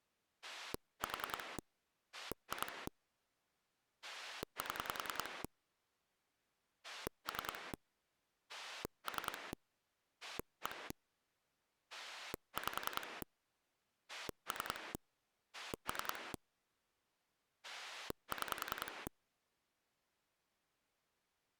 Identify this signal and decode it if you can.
Pulse dialling, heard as a rotary dial, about 10 pulses a second. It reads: 4 2 7 3 3 1 5 3 3 6